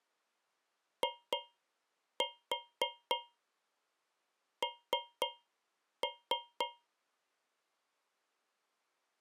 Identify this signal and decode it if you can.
Tap code, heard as taps on a metal pipe, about 3 knocks a second. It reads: IN